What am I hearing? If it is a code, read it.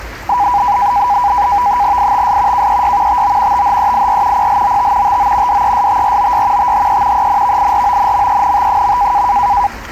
NAVTEX (SITOR-B), 100 baud, 170 Hz shift, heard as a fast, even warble, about 900 Hz centre, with the noise of a park. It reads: ITS KEY TO THEIR PLOT TO DESTROY THE ENVIRONMENT.